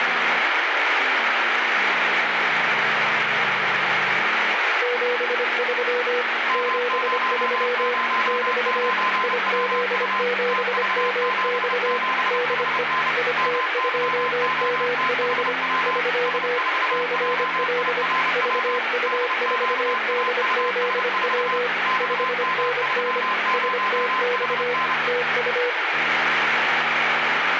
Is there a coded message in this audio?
Yes: Morse code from 4.8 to 25.8 s, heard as two keyed tones, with radio static. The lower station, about 25 wpm, 490 Hz: 73 73 <BT> IZ7MX DE IT2ML <SK> CL VU4DZW 5NN STX TU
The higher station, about 30 wpm, 1030 Hz: M009WU TV77HN MYOTHW S4JIRW DQAUS4 XM30HN